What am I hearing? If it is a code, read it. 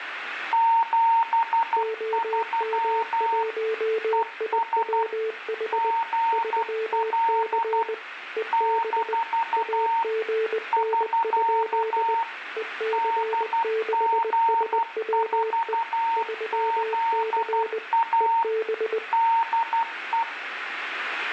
Morse code, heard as two keyed tones, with radio static. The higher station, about 12 wpm, 920 Hz: 73 ES GL - <SK> DG4ZA DE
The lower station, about 20 wpm, 440 Hz: OM1IWH 3C EB AGN? EC6SWE 3C EB